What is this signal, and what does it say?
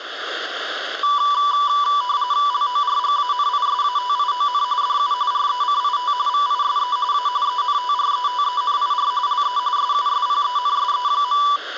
RTTY (45.45 baud, 170 Hz shift), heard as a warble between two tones, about 1070 Hz centre, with room echo. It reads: LORGANISATION DU RECIT VISE A ENTRETENIR LE SUSPENSE.